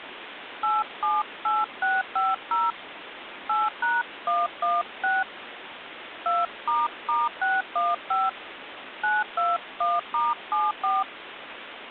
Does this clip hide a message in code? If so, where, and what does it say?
Yes: DTMF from 0.6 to 11.0 s, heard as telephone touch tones, dialled by hand, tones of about 190 ms, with phone line noise. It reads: 878650 8#116 2**615 921*74